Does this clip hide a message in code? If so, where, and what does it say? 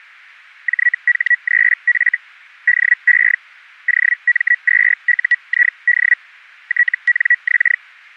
Yes: Hellschreiber (Feld-Hell, 122.5 baud) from 0.7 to 7.8 s, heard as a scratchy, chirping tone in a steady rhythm, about 1950 Hz. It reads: JH3F DE OM2UID TNX